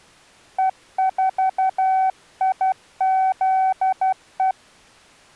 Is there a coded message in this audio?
Yes: Morse code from 0.5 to 4.6 s, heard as a keyed tone, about 12 wpm, 760 Hz. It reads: E4IZE